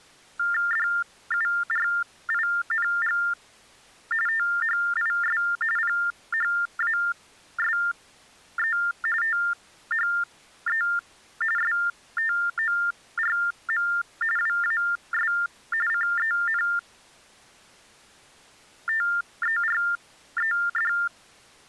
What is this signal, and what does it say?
TTY/TDD text telephone tones (45.45 baud Baudot), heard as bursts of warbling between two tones, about 400 Hz shift, 1600 Hz centre. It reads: DURING THIS PHASE THE STORM WAS CENTERED